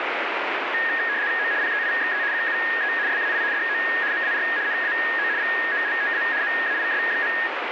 RTTY (75 baud, 170 Hz shift), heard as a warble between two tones, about 1750 Hz centre, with radio static. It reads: O PEIXE QUE SAI DO MAR NAO VOLTA MAIS.